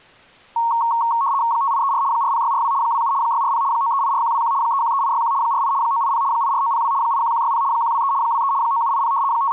RTTY (75 baud, 170 Hz shift), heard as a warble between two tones, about 1010 Hz centre. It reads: 5834 40642 27 640 9384121 313861 48 980 84902 81160 123 23 9780 …